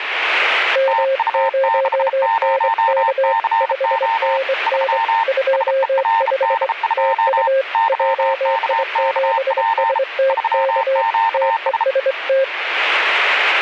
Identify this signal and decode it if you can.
Morse code, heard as two keyed tones, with radio static. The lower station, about 24 wpm, 540 Hz: M0NK 5NN 25 TU JI7STK TEST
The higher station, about 33 wpm, 910 Hz: TU60CO 3 SERD2 YKKP 3QS